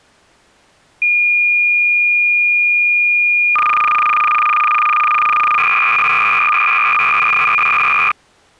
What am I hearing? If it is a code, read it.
Cassette data (Kansas City type), 300 baud, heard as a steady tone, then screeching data.